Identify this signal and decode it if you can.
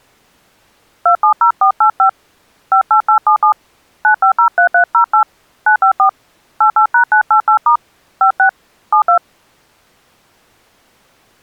DTMF, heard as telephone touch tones, dialled by hand, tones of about 100 ms. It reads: 270485 58877 9503308 954 88#988* 56 72